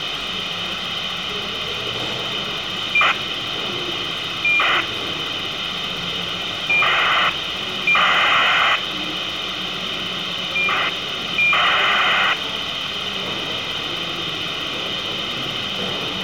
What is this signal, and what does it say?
ACARS aircraft data, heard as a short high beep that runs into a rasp, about 2400 baud, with radio hiss.